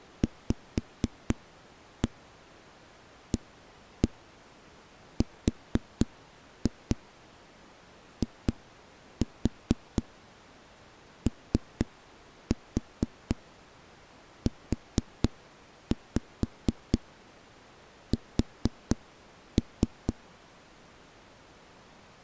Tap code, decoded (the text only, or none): VARIOUS